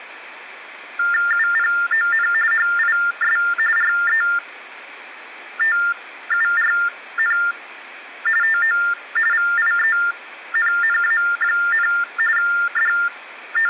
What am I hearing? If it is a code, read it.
TTY/TDD text telephone tones (45.45 baud Baudot), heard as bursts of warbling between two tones, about 400 Hz shift, 1600 Hz centre, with phone line noise. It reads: UPON HIS RETURN TO VIENNA, …